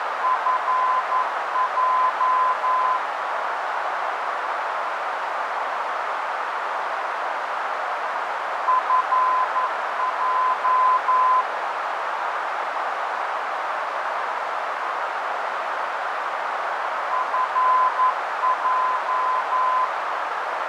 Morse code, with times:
0.2-3.0 FJ
8.7-11.4 FJ
17.1-19.8 FJ

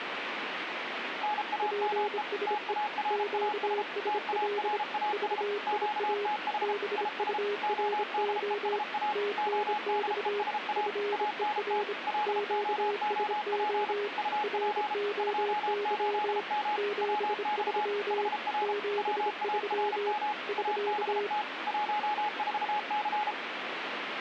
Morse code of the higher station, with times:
1.2-2.2 NAME
2.5-3.8 TARAS
4.1-5.4 TARAS
5.7-6.7 QTH
7.0-7.4 IS
7.6-9.1 ODESA
9.4-10.9 ODESA
11.1-11.8 ANT
12.1-13.9 LOOP
14.2-14.9 UP
15.2-16.8 28M
17.0-17.9 WX
18.1-18.7 HR
19.0-20.3 WARM
20.6-21.4 ABT
21.7-23.3 14C

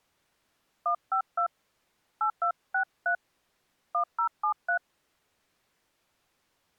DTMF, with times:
0.9-1.5 152
2.2-3.2 8263
3.9-4.8 1073

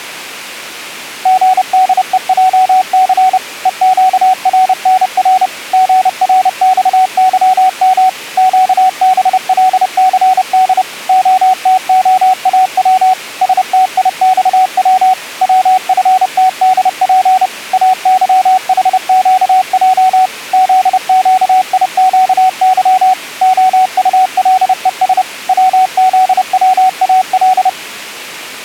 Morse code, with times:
1.3-3.4 GDEJC
3.7-5.5 EQRNR
5.7-8.1 GRXYM
8.4-10.8 QBLCD
11.1-13.1 OTOAW
13.4-15.1 STIXW
15.4-17.5 WFTDP
17.7-20.3 AYHQJ
20.5-23.1 ZQIQY
23.4-25.2 OULES
25.5-27.7 WZWAL

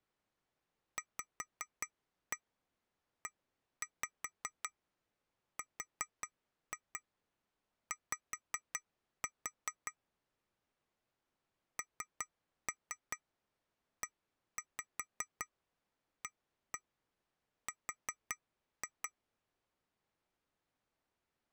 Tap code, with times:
1.0-9.9 VERY
11.8-19.1 NEAR

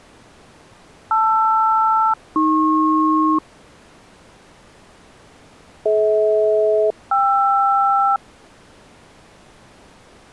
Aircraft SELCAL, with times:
1.1-3.4 LR-AP
5.9-8.2 DH-KR

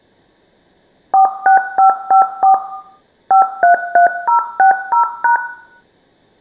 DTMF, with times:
1.1-2.5 46554
3.3-5.4 533060#

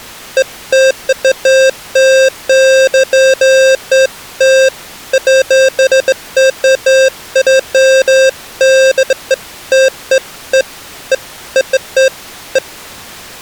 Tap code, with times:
none

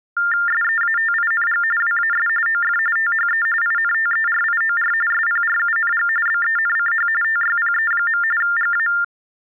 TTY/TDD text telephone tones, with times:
0.5-1.6 SEATING
1.8-2.3 WAS
2.5-2.8 OF
3.0-3.5 THE
3.6-4.9 INTERIOR
5.1-6.1 SPRUNG
6.3-7.1 BENCH
7.2-8.2 TYPE.
8.4-8.9 GA

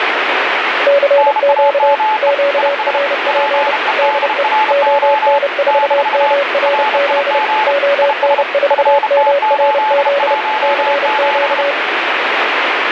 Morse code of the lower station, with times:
0.9-1.9 CQ
2.2-3.7 QRP
4.0-4.4 DE
4.7-7.4 ON4MRZ
7.7-10.3 ON4MRZ
10.6-11.7 CQ

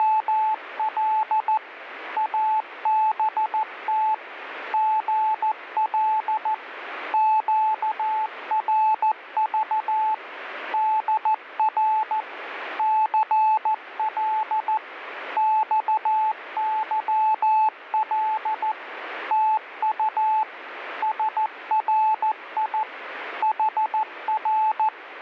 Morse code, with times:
0.0-1.6 …
2.2-4.1 ABT
4.7-6.5 GL
7.1-10.1 QRV
10.7-12.2 DR
12.8-14.8 CL
15.4-18.7 XYL
19.3-20.4 TU
21.0-22.8 SRI
23.4-24.9 HR

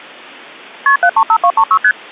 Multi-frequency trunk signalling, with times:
0.9-1.0 KP
1.0-1.8 735236
1.8-1.9 ST

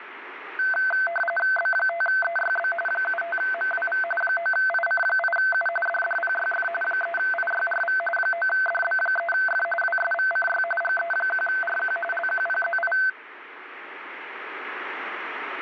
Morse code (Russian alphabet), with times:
none

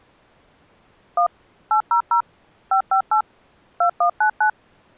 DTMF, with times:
1.2-1.3 1
1.7-2.2 800
2.7-3.2 558
3.8-4.5 2199

